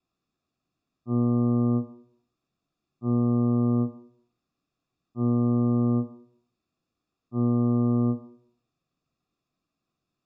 Ship horn signal, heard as a ship's horn, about 120 Hz, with room echo. 4 short. At sea: a pilot vessel's identity signal in fog.